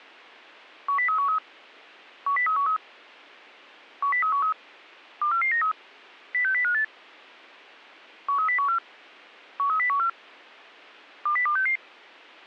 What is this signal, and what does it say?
Five-tone selective call (CCIR), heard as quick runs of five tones, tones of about 100 ms. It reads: 10313 10313 10313 24493 06058 13014 13014 20266